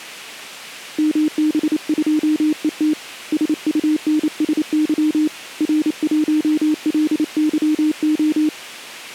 Morse code, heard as a keyed tone, hand-sent with a paddle, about 28 wpm, 310 Hz. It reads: MB2ET SUNSY R1LYO